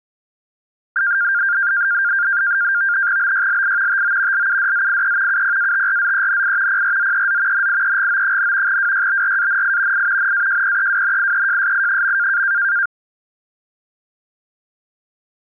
NAVTEX (SITOR-B), 100 baud, 170 Hz shift, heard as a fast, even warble, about 1500 Hz centre. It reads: BYLI TO LUDZIE UPATRZENI PRZEZ NIEGO, WYBRANI I NAJPEWNIEJSI.